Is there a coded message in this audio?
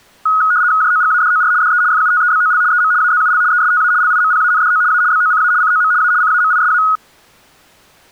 Yes: RTTY (75 baud, 170 Hz shift) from 0.3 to 7.0 s, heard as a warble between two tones, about 1360 Hz centre. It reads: JOGADOR DE FUTEBOL EM AZUL ESTA LIMPANDO A BOCA COM A CAMISA